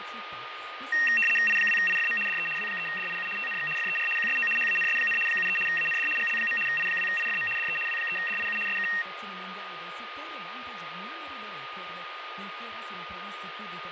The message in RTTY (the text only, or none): I2IFM DE W3DIU TNX FER QSO HANS, 73 AND GL. I2IFM DE W3DIU SK